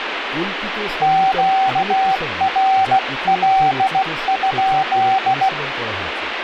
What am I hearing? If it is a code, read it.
Morse code, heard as a keyed tone, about 16 wpm, 770 Hz, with radio static and speech in Bangla. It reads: QRL?